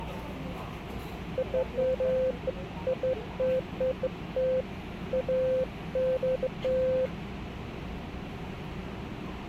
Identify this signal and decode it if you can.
Beeps of irregular length, with the noise inside a subway train. There is no code.